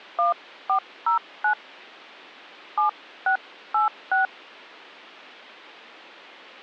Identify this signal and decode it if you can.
DTMF, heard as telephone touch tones, dialled by hand, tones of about 100 ms. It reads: 1409 7686